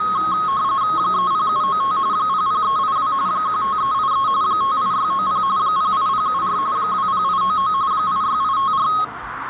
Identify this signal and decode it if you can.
RTTY (45.45 baud, 170 Hz shift), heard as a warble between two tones, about 1170 Hz centre, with radio static, a narrow filter and the noise of a crowd indoors. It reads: 30795 00382 15383 58690 08074 20899 86854